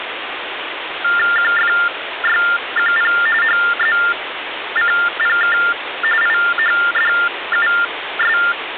TTY/TDD text telephone tones (45.45 baud Baudot), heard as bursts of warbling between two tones, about 400 Hz shift, 1600 Hz centre, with phone line noise. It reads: QFYQP HZCPK IHDUS